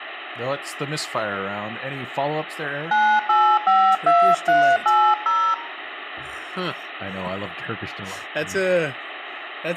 DTMF, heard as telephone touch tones, dialled by hand, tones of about 280 ms, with phone line noise and speech in English. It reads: 9852380